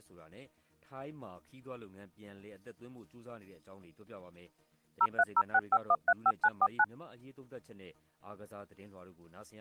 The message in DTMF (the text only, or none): 03065135949